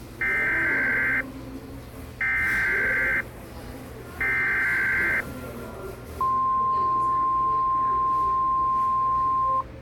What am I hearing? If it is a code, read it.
Emergency Alert System (SAME) tones (header bursts, then the 1050 Hz attention tone), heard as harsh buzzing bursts, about 520.83 baud, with the noise of a cafe.